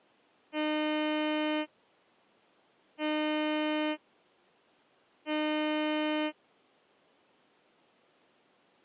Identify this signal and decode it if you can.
Ship horn signal, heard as a ship's horn, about 300 Hz. 3 short. At sea: I am operating astern propulsion.